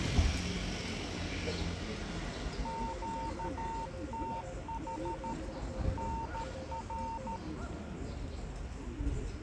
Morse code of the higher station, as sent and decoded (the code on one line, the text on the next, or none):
--.- - .... / -. .-.
QTH NR